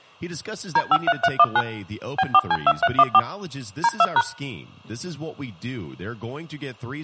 DTMF, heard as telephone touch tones, dialled by machine, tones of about 50 ms, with speech in English. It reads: D53319 B4C2314 D2#